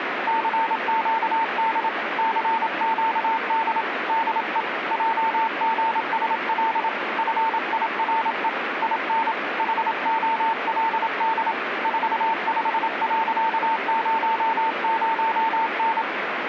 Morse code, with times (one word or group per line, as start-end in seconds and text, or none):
0.3-1.9 CQD
2.2-3.8 CQD
4.1-4.6 DE
4.9-6.9 JGSL
7.2-8.5 FIRE
8.8-9.3 IN
9.6-11.5 HOLD
11.8-16.0 45.00N